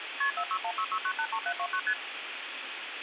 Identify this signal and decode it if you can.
Multi-frequency trunk signalling (R1, as on North American trunks), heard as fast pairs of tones, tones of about 70 ms, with phone line noise. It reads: KP 46166983729 ST